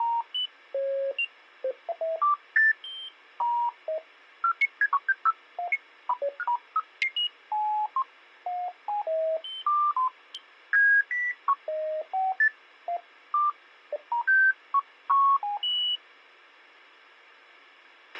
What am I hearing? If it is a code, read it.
Electronic bleeps of random pitch and length, with a squelch burst at the end. There is no code.